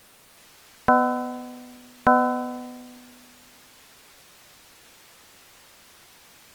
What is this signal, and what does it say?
Clock strike, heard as a bell. 2. Two o'clock.